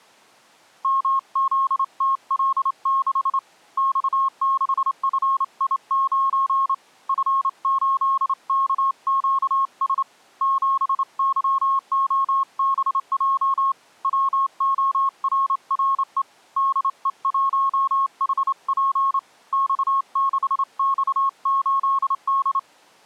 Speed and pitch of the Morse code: 28 wpm, 1080 Hz

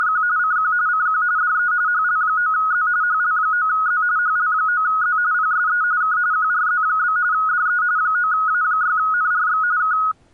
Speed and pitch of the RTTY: 45.45 baud, 170 Hz shift, 1360 Hz centre

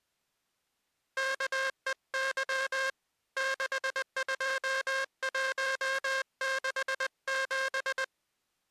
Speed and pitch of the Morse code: 20 wpm

